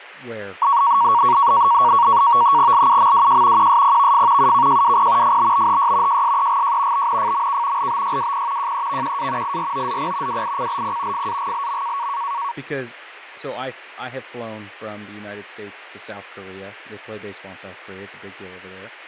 NAVTEX (SITOR-B), 100 baud, 170 Hz shift, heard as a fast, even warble, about 1030 Hz centre, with fading and speech in English. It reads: LUMWJ QSPVF UKJWP FBBHY JSEGJ BNFMK LBYWP JEVQA IROZP WICLP FAGLM